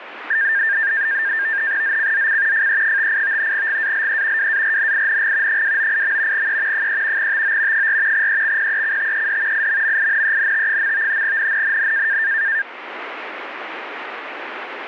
NAVTEX (SITOR-B), 100 baud, 170 Hz shift, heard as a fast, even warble, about 1700 Hz centre, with radio static. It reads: ZCZC FE58 GALE WARNING 298. E 3 TO 4 EXPECTED IMMINENT. NNNN